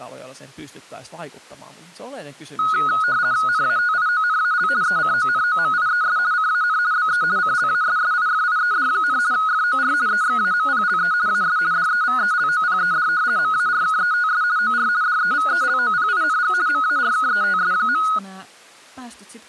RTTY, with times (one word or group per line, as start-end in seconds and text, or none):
3.5-4.7 NATIONAL
4.8-6.2 ECONOMIES
6.3-6.8 CAN
6.9-7.2 BE
7.4-9.2 CLASSIFIED,
9.3-9.9 FOR
10.1-11.1 EXAMPLE
11.3-11.6 AS
11.7-13.1 DEVELOPED
13.4-14.4 MARKETS
14.6-14.9 OR
15.0-16.5 DEVELOPING
16.7-18.0 MARKETS.